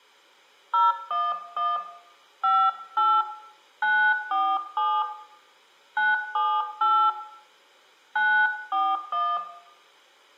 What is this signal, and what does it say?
DTMF, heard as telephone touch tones, dialled by hand, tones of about 240 ms, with room echo. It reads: 011 58 947 978 941